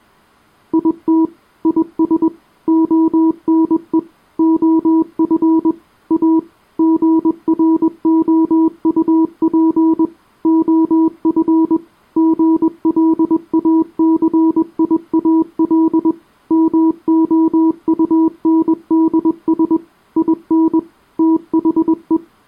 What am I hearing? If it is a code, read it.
Morse code, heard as a keyed tone, machine-sent, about 21 wpm, 320 Hz. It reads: IT IS ONE OF A GROUP OF GLACIAL MOUNDS IN THE